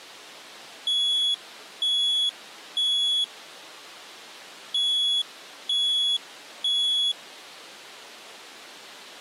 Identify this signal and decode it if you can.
Alarm pattern, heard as an alarm's beeps, played twice, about 3350 Hz. Temporal three. Smoke or fire, evacuate.